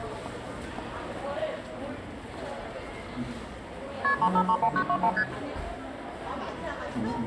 Multi-frequency trunk signalling (R1, as on North American trunks), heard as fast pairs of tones, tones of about 70 ms, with room echo and the noise of a crowd indoors. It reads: KP 3531921 ST